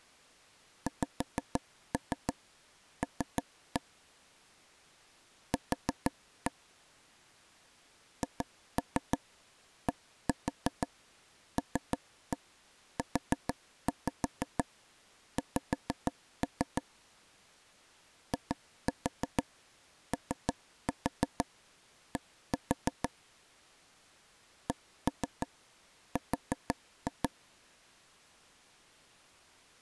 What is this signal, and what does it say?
Tap code, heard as taps on a table, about 6 knocks a second. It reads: XL Q HDLUX IOD CR